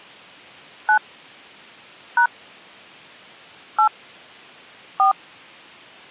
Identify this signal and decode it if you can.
DTMF, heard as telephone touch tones, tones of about 110 ms. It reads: 9 # 8 4